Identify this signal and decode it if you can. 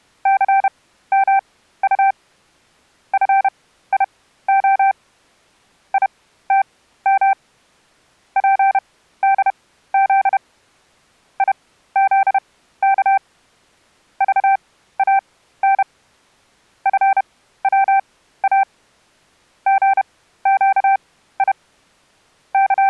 Morse code, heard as a keyed tone, machine-sent, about 31 wpm, spaced as for 15 wpm, 780 Hz. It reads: CMU FIO ITM PDZ IZK VAN FWA GQI …